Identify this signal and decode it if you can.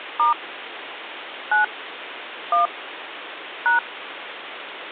DTMF, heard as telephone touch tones, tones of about 130 ms, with phone line noise. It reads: * 9 1 #